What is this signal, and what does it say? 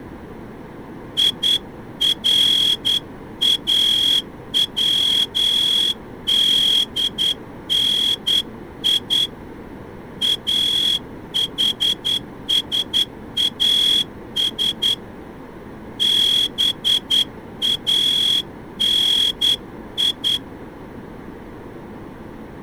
Morse code (Arabic alphabet), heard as a whistle, hand-sent with a straight key, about 10 wpm. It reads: يراودني احساس باني